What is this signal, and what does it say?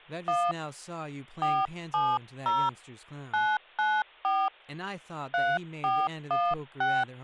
DTMF, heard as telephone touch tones, dialled by hand, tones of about 230 ms, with hum and speech in English. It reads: 1 470 994 3416